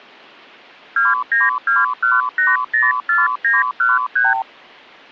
Multi-frequency trunk signalling (R2, with the far end's replies), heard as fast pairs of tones, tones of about 180 ms. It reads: 2921804913